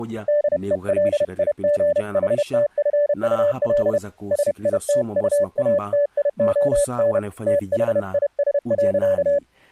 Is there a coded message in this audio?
Yes: Morse code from 0.2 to 9.4 s, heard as a keyed tone, hand-sent with a paddle, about 31 wpm, 580 Hz, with speech in Swahili. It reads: DELIGHTFUL SITUATION THIS.